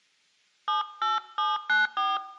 DTMF, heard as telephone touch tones, dialled by hand, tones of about 190 ms, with room echo. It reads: 78794